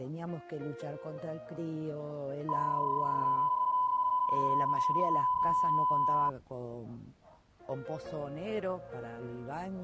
PSK31 (31.25 baud), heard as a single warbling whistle, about 1000 Hz.